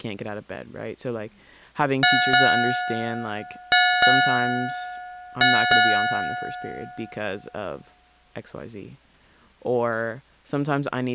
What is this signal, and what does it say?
Ship's bell, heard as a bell, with speech in English. 6. Six half-hours of the watch have passed.